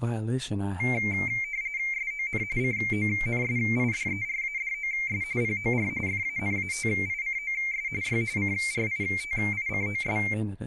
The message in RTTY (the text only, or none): SON CONSIDERADOS POR FANATICOS Y CRITICOS